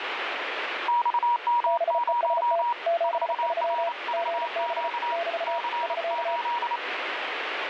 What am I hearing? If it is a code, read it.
Morse code, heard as two keyed tones, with radio static. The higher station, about 28 wpm, 960 Hz: XM0 4RVQ C8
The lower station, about 34 wpm, 680 Hz: BEST 73 GB <BT> <SK>